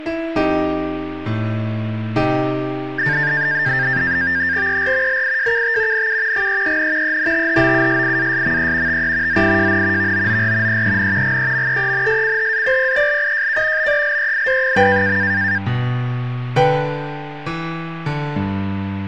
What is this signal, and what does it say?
NAVTEX (SITOR-B), 100 baud, 170 Hz shift, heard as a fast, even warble, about 1700 Hz centre. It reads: ER LIJKT NU GEEN ENTHOUSIASME TE ZIJN VOOR EEN GEMEENSCHAPPELIJK BELEID.